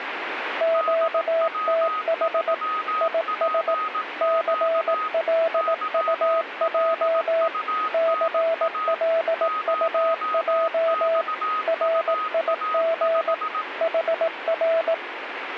Morse code, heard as two keyed tones, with radio static. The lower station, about 18 wpm, 660 Hz: QTH IS CLUJ CLUJ RIG HR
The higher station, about 18 wpm, 1260 Hz: DW3PQ YLUNA 0XUA5